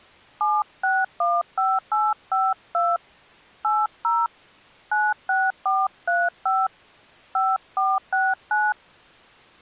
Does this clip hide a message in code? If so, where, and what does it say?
Yes: DTMF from 0.4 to 8.7 s, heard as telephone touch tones, dialled by hand, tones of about 210 ms. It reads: 7615852 80 96435 5469